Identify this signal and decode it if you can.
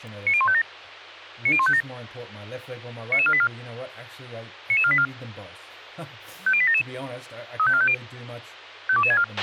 Five-tone selective call (ZVEI), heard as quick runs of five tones, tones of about 70 ms, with a squelch burst at the end and speech in English. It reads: 90157 90157 99484 99484 50877 35450 52264